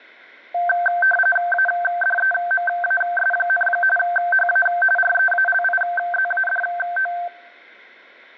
RTTY (45.45 baud, 850 Hz shift), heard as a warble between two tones, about 1120 Hz centre. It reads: ADEMAS, HA REALIZADO